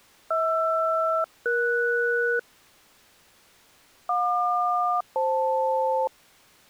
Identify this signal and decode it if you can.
Aircraft SELCAL, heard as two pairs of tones. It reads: HR-ES JQ-FL